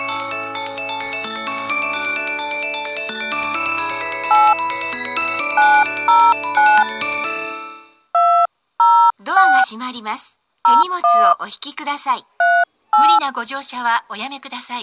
DTMF, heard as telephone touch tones, dialled by hand, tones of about 240 ms. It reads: 8 909 206 01 38